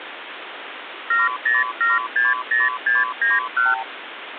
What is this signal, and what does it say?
Multi-frequency trunk signalling (R2, with the far end's replies), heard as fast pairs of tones, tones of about 180 ms, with phone line noise. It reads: 70760691